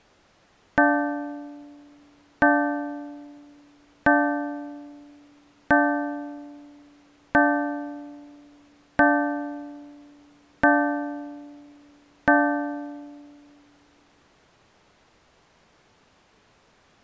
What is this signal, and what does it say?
Clock strike, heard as a bell. 8. Eight o'clock.